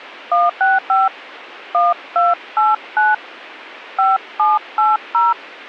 DTMF, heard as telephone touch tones, dialled by hand, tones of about 180 ms. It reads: 165 1289 5780